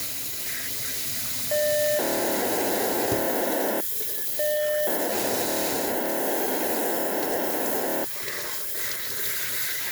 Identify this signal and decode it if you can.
POCSAG pager data (1200 baud), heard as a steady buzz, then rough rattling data, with a squelch burst at the end and kitchen noise.